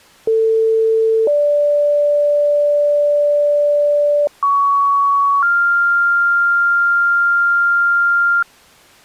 Two-tone page, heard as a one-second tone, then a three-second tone, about 450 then 580 Hz, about 1120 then 1400 Hz.